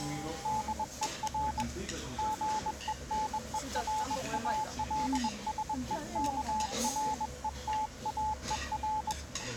Morse code, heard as a keyed tone, hand-sent with a bug key, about 21 wpm, 860 Hz, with the noise of a restaurant. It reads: DER GENERALSEKRETAER